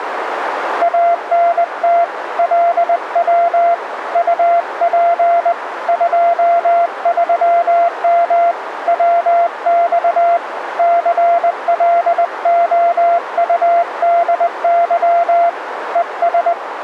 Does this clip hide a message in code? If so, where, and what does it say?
Yes: Morse code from 0.8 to 16.6 s, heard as a keyed tone, hand-sent with a paddle, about 20 wpm, 690 Hz, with radio static and a narrow filter. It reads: ANT LW UP 23M WX CLOUDY ES